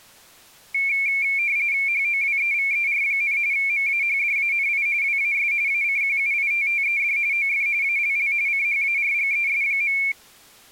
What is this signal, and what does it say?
RTTY (45.45 baud, 170 Hz shift), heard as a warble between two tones, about 2300 Hz centre. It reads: HOWEVER, MAHDANI WAS ACQUITTED OF ALL CHARGES.